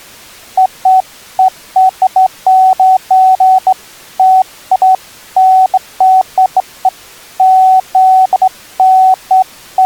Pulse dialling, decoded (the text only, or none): none